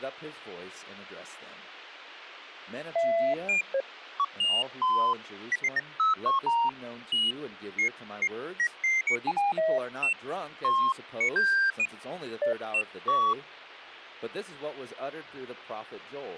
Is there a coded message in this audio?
No, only electronic bleeps of random pitch and length, with radio hiss.